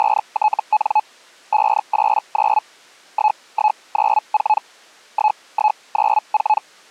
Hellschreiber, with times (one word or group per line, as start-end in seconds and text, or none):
0.0-1.0 …
1.5-2.6 589
3.1-4.6 1194
5.1-6.6 1194